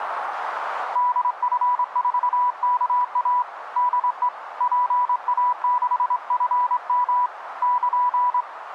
Morse code, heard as a keyed tone, hand-sent with a straight key, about 24 wpm, 990 Hz, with radio static and a narrow filter. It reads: DF4KA DE PA6FM <KN>